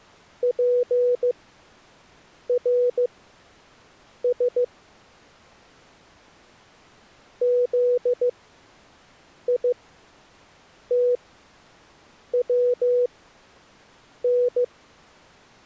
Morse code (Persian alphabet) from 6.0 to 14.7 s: زیتون

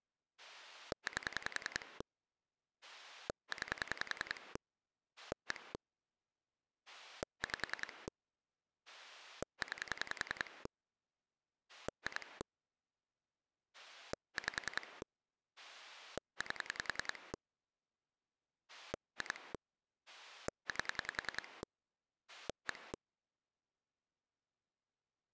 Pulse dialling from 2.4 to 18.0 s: 9 1 5 9 2 5 8

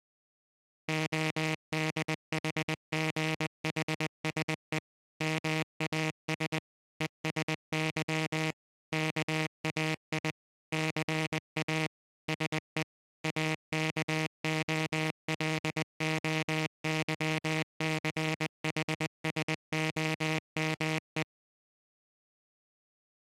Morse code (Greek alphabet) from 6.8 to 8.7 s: ΕΣΥ

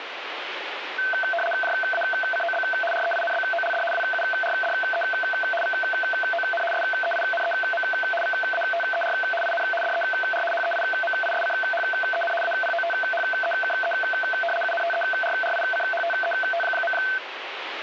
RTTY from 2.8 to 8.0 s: REINBOLD WURDE VON SEINEM

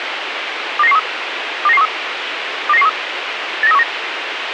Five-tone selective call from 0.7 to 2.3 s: 29913 29913

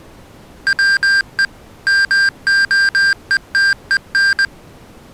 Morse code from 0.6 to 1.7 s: WE

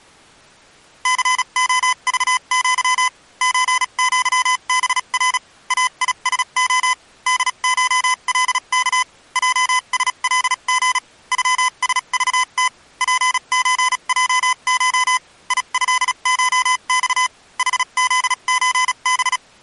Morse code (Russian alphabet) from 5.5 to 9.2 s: АИСО ДШЛК

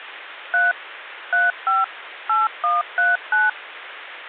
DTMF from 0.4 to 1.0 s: 3

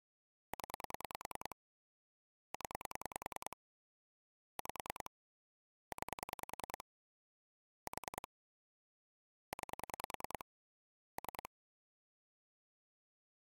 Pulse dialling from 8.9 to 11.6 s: 9 3

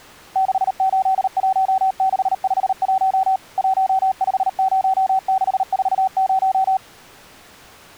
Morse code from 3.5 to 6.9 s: 150640

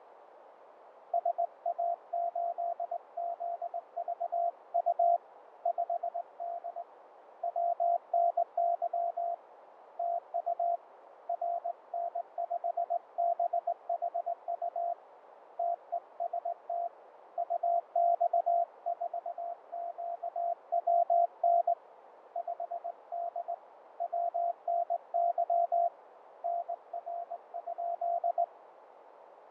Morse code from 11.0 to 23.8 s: RN5BHU TEST UX4QWN 5D

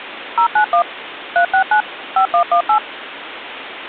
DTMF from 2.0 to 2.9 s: 5118

